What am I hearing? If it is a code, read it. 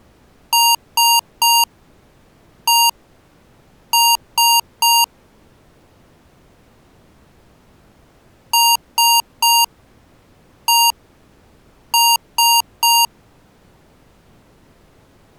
Beep code, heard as beeps from a small speaker, played twice, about 930 Hz. 3-1-3. In Phoenix BIOS tables: interrupt mask register failure.